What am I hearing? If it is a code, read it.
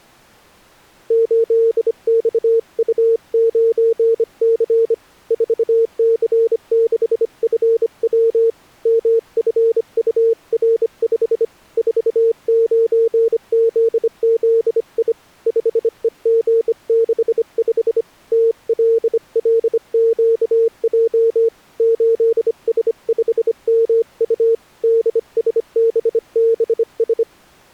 Morse code, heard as a keyed tone, hand-sent with a bug key, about 25 wpm, 460 Hz. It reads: 8XU9C 4C6FW MFUR5 49ZZI 5EG65 TLLQJ 8S5MU DSBBS